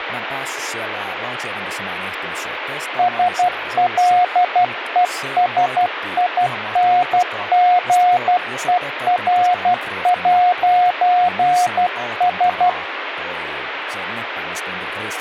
Morse code, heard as a keyed tone, hand-sent with a paddle, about 12 wpm, 720 Hz, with radio static and speech in Finnish. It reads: SLESINGER'S